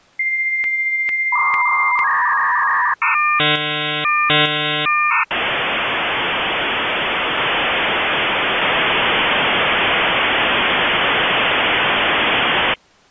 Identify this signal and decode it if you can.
Dial-up modem handshake (V.34 or later), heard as a whistle, warbles, then hiss.